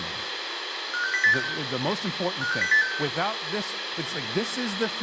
Five-tone selective call (CCIR), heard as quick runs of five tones, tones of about 100 ms, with radio hiss and room echo. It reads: 56086 56086